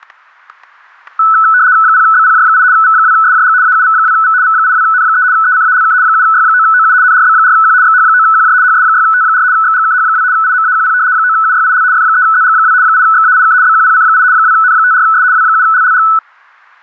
RTTY (75 baud, 170 Hz shift), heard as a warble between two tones, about 1400 Hz centre, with static crashes. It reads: 0BPJ8 V2SJG AUV2V V82N3 ECALK 7Y9OU NRB4Q XH9QJ HS6T4 XGKH2 IMAQP 9UYIL F3ZG2 8XAIK BQPC8 2N54S W7LLG